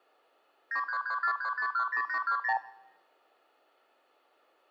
Multi-frequency trunk signalling (R2, with the far end's replies), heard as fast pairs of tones, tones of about 90 ms. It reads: 93343510820